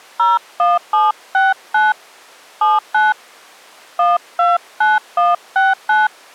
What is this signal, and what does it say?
DTMF, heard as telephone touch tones, dialled by hand, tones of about 180 ms. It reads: 01769 79 129169